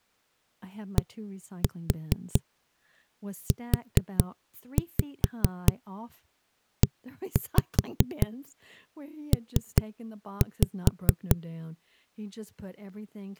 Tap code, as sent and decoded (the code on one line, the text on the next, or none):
1-4 4-5 1-5 3-5
DUEP